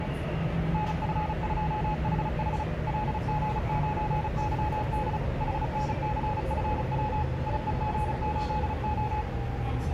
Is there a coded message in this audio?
Yes: Morse code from 0.7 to 9.3 s, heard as a keyed tone, machine-sent, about 35 wpm, 850 Hz, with the noise inside a subway train. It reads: NF2HH LG9YD HNCFW IEG8O